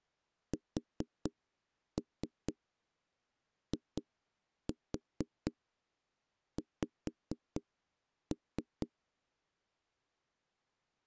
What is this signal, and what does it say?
Tap code, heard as knocks on wood, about 4 knocks a second. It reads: SIX